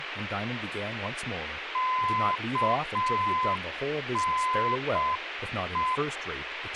Morse code, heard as a keyed tone, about 6 wpm, 1020 Hz, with radio hiss and speech in English. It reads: KNE